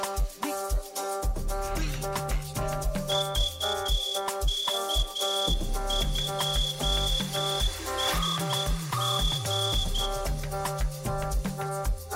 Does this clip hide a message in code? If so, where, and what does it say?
Yes: Morse code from 3.0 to 10.1 s, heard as a whistle, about 10 wpm, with room echo. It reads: VK2SG